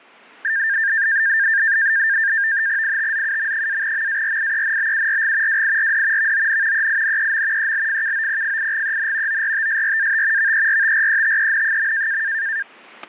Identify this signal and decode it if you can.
NAVTEX (SITOR-B), 100 baud, 170 Hz shift, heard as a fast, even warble, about 1700 Hz centre, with static crashes. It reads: ITZUM-MARIENBURG WIRD VON EINEM ELFKOPFIGEN ORTSRAT VERTRETEN.